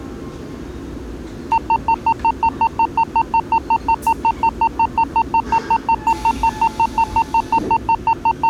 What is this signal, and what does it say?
Evenly repeated beeps, with the noise inside a subway train. There is no code.